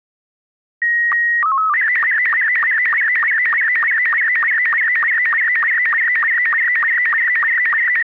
SSTV (slow-scan television), Robot 72, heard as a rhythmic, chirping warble.